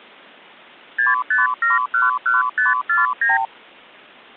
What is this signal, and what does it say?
Multi-frequency trunk signalling (R2, with the far end's replies), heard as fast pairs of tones, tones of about 160 ms. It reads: 65711549